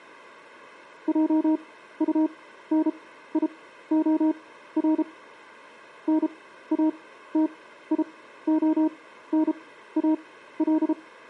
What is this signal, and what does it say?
Morse code, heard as a keyed tone, machine-sent, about 33 wpm, spaced as for 15 wpm, 310 Hz. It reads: JUNIOR NATIONAL